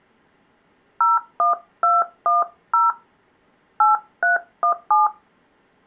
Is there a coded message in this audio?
Yes: DTMF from 1.0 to 5.1 s, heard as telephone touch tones, dialled by hand, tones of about 140 ms. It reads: 01210 8317